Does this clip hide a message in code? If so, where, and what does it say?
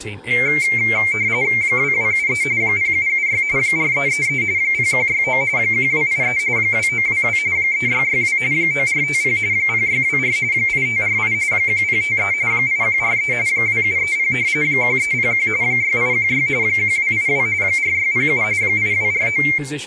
Yes: RTTY (45.45 baud, 170 Hz shift) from 0.3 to 19.6 s, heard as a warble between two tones, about 2200 Hz centre, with room echo and speech in English. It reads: 2273 0776 4333 0169 1283 2922 3662 9450 0624 8548 1053 8143 2730 1301 6816 1282 4607 8249